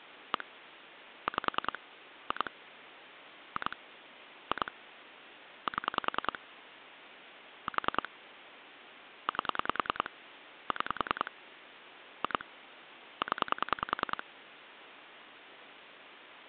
Pulse dialling, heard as clicks on a phone line, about 10 pulses a second. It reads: 1 5 2 2 2 7 4 8 6 2 0